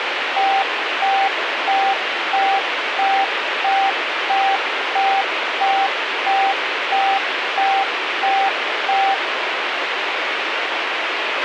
Evenly repeated beeps, with radio hiss and a squelch burst at the end. There is no code.